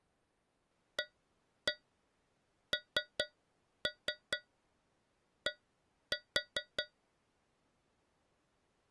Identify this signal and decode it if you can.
Tap code, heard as taps on a metal pipe, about 4 knocks a second. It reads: AND